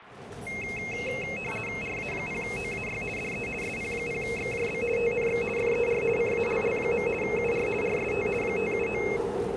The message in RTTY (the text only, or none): RA0OAY DE SP0XJB TNX FER CALL. UR RST 579